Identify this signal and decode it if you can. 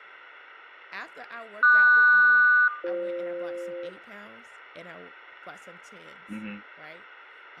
Aircraft SELCAL, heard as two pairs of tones, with radio static, fading, room echo and speech in English. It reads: QS-BF